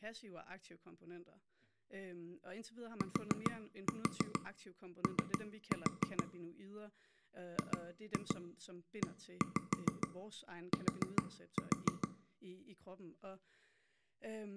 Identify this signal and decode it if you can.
Tap code, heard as taps on a table, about 7 knocks a second, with room echo and speech in Danish. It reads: TO GET